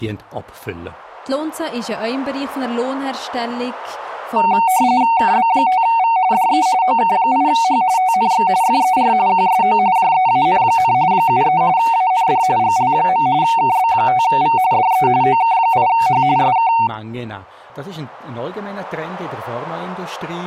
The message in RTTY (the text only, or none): KB5V DE OK8H TNX FER QSO JEAN, 73 AND GL. KB5V DE OK8H SK